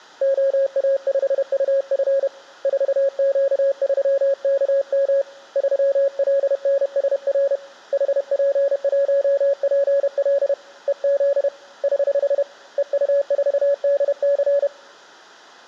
Morse code, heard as a keyed tone, hand-sent with a paddle, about 31 wpm, 560 Hz. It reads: OA5UF 4Q3KM 3LNSR HP1PL EZ <HH> EU4DC